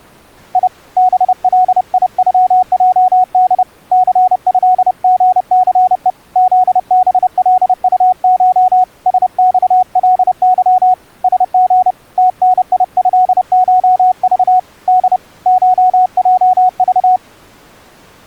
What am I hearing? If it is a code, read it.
Morse code (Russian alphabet), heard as a keyed tone, hand-sent with a paddle, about 30 wpm, 740 Hz. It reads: И БЛИЮЙД ЦЭГЦЕ ЗБЛУШ СЬЛЫ СГ ТНИЭШЖ Д ШЙЖ